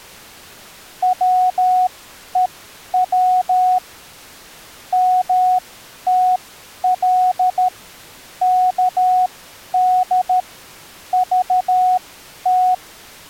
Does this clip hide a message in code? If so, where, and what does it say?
Yes: Morse code (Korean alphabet) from 1.0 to 12.8 s, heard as a keyed tone, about 13 wpm, spaced as for 10 wpm, 740 Hz. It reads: 밥 먹으러